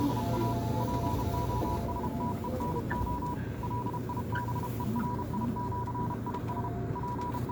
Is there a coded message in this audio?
Yes: Morse code (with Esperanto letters) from 0.0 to 7.5 s, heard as a keyed tone, hand-sent with a paddle, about 32 wpm, 980 Hz, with the noise inside a subway train. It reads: … POSTENO LIBERIĜIS …